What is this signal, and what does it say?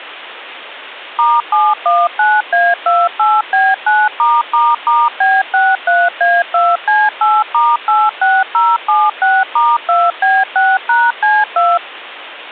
DTMF, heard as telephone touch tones, dialled by machine, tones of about 220 ms. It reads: *719A28B9***B63A2C8*86076*2B6#C2